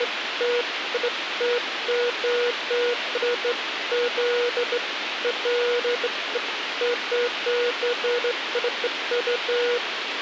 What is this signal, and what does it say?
Beeps of irregular length, with radio hiss and a squelch burst at the end. There is no code.